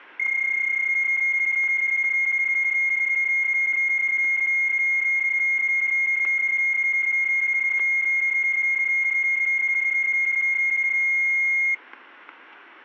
PSK31 (31.25 baud), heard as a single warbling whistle, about 2150 Hz, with static crashes.